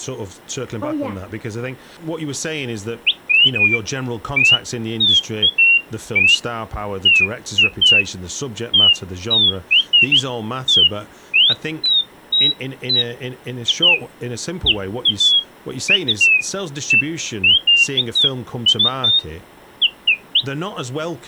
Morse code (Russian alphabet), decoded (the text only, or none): none